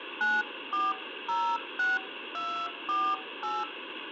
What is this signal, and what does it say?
DTMF, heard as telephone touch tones, dialled by hand, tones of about 250 ms, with phone line noise. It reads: 9406248